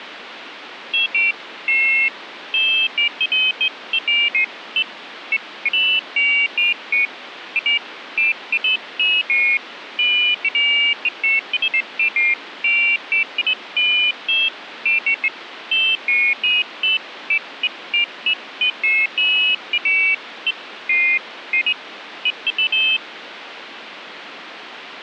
Pairs of high tones at irregular times, with radio static. There is no code.